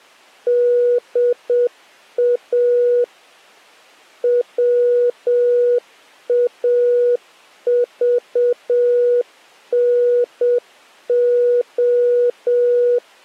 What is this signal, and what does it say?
Morse code (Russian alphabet), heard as a keyed tone, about 7 wpm, 480 Hz. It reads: ДА ВАЖНО